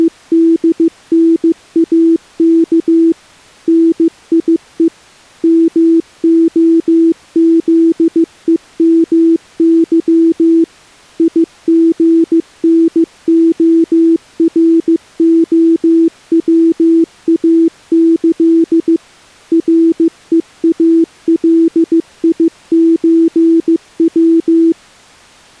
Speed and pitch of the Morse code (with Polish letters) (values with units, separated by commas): 15 wpm, 330 Hz